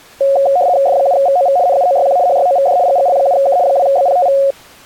RTTY (75 baud, 170 Hz shift), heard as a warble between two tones, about 640 Hz centre. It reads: F7VOV NUOYQ HYOVD GGL7K 2BPTV